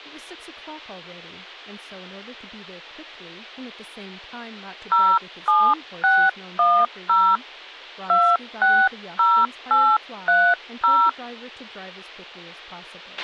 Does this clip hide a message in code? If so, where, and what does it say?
Yes: DTMF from 4.9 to 11.1 s, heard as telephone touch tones, dialled by hand, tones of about 260 ms, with a squelch burst at the end and speech in English. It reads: 07610 260830